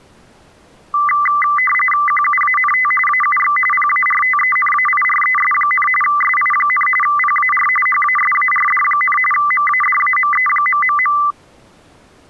RTTY (45.45 baud, 850 Hz shift), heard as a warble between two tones, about 1600 Hz centre. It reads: QUANT AUX PARTENAIRES, SI, PAR HASARD, MADAME...